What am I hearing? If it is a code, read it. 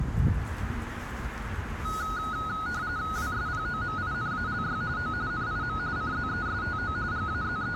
RTTY (45.45 baud, 170 Hz shift), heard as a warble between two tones, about 1360 Hz centre, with radio static and the noise of a residential street. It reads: WSPOMINALY O NIM CZESTO …